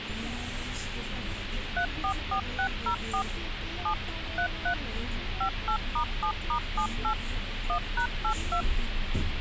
DTMF, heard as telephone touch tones, dialled by machine, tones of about 90 ms, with radio hiss and the noise inside a bus. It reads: 344604 7 33 58*7*78 1#82